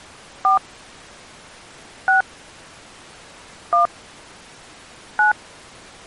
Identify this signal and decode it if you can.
DTMF, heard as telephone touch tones, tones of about 130 ms. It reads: 4 6 1 9